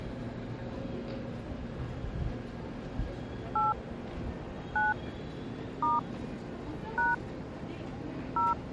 DTMF, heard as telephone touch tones, dialled by hand, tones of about 170 ms, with the noise of a subway station. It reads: 8 9 * # 0